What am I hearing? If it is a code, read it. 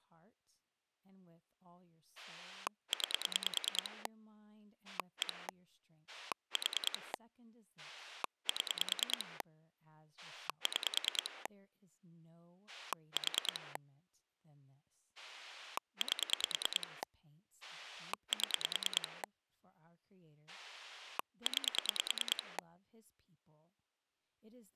Pulse dialling, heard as a rotary dial, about 9 pulses a second, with speech in English. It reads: 9 1 4 7 6 4 8 7 9